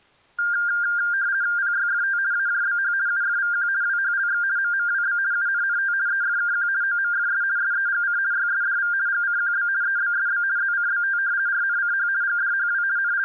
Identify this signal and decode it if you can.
RTTY (50 baud, 170 Hz shift), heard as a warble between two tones, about 1500 Hz centre. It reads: PYFT AJBH UFVQ WHLX MMWB UNNT EFKQ OMFS SEGC YSDV GCQB EBSB ZCBT RNCH GDHW …